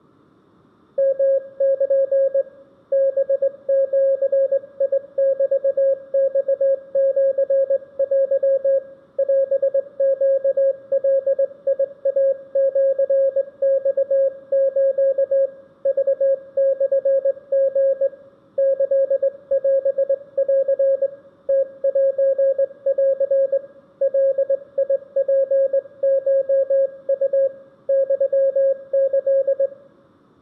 Morse code (Japanese Wabun code), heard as a keyed tone, hand-sent with a straight key, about 20 wpm, 540 Hz, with room echo. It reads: ヨル ハジメマシテ オネガイシマス クモリ キオン ムセン ガツコウ ユキ